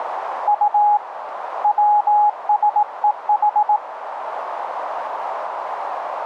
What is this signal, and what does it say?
Morse code (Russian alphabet), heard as a keyed tone, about 18 wpm, 830 Hz, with radio static and a narrow filter. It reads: У ВСЕХ